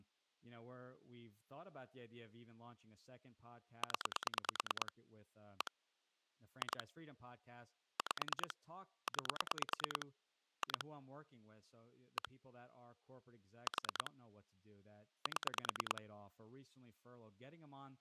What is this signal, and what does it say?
Pulse dialling, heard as clicks on a phone line, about 9 pulses a second, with speech in English. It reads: 0 1 2 5 9 2 1 4 7